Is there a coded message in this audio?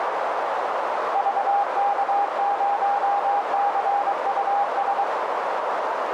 Yes: Morse code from 1.1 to 5.1 s, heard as a keyed tone, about 23 wpm, 810 Hz, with heavy radio static and a narrow filter. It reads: VK0CUS